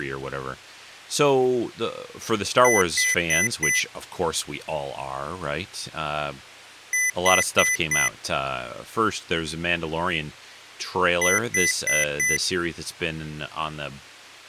Beep code, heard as beeps from a small speaker, played three times, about 2000 Hz, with speech in English. 4 short. In AMI BIOS tables: system timer failure; in Dell tables: memory read or write failure.